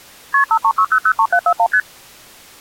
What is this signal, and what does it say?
Multi-frequency trunk signalling (R1, as on North American trunks), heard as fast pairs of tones, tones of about 70 ms. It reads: KP 536003741 ST